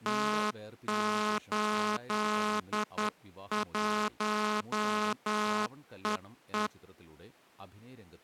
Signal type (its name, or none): Morse code